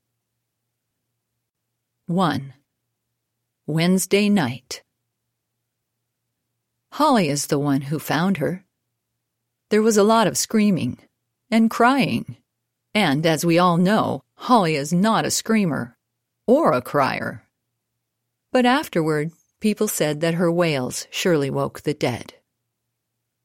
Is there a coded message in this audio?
No.